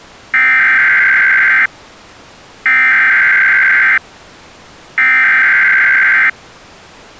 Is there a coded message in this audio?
Yes: Emergency Alert System (SAME) tones (header bursts) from 0.3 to 6.3 s, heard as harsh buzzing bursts, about 520.83 baud.